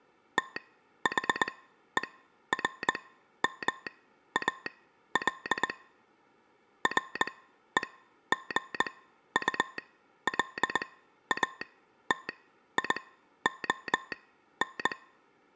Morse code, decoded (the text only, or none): THERMAL REGULATION